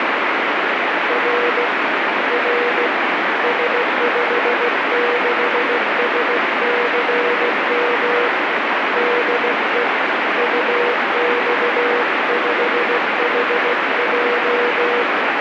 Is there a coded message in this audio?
Yes: Morse code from 1.0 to 15.1 s, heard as a keyed tone, hand-sent with a paddle, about 16 wpm, 480 Hz, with heavy radio static. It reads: R R S56SCM DE UX5HJ